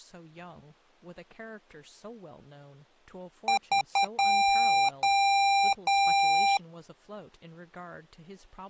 Beep code, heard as beeps from a small speaker, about 790 Hz, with speech in English. 3 short, 3 long.